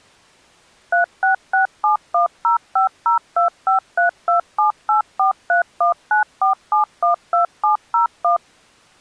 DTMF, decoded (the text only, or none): 3667105025327843194712701